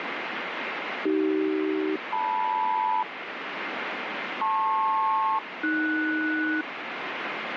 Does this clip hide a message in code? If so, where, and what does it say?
Yes: aircraft SELCAL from 1.1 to 6.6 s, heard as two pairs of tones, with radio static. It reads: AC-LM LP-AS